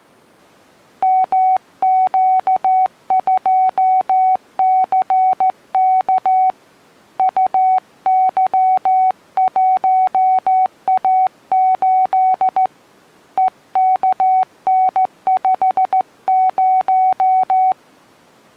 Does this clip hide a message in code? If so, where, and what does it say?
Yes: Morse code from 1.0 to 17.8 s, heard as a keyed tone, hand-sent with a straight key, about 14 wpm, 750 Hz. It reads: MQ2CK UY1A8 EKN50